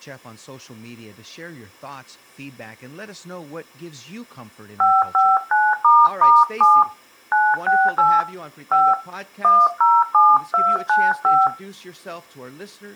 DTMF, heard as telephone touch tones, dialled by hand, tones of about 220 ms, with speech in English. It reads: 559**7 968 5 107295